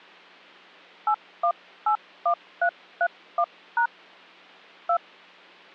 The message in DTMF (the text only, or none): 8181331# 2